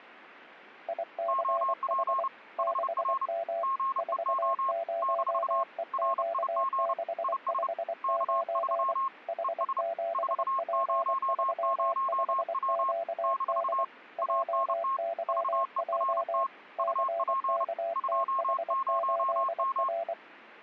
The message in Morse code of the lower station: ICH 6M 40EQ659 H7P35QD JYJ CKTH8R

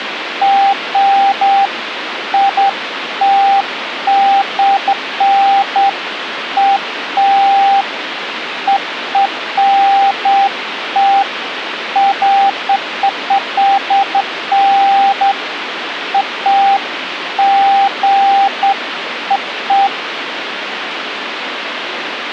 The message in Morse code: none

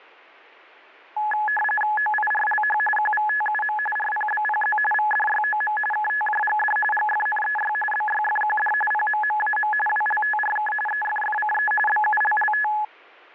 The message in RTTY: OIRLH QVTUM RPBPZ VDYOM KTJGD GFNEY BYFQD PMMAM WLTRK EFFCE BULLT

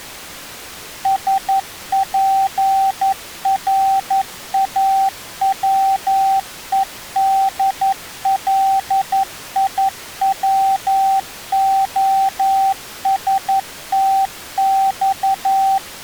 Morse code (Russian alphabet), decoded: СПРАВЕДЛИВОСТЬ

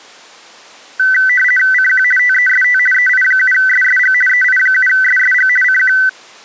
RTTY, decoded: CQ TEST EI7SSG EI7SSG CQ

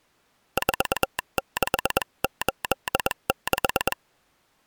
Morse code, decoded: 4686

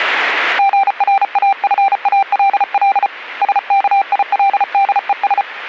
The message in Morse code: GRAFALL SKILDES

